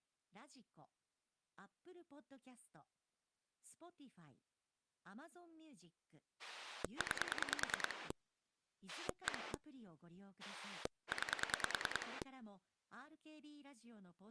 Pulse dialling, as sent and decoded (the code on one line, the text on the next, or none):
9 / 1 / 9
9 1 9